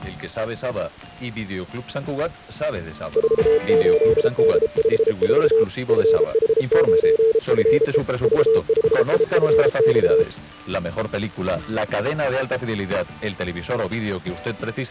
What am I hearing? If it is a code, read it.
Morse code, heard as a keyed tone, hand-sent with a paddle, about 33 wpm, 450 Hz. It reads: 48D54 FH9FE V5IFX